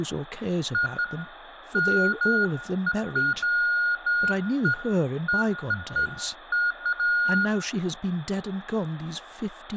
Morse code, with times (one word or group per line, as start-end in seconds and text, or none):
none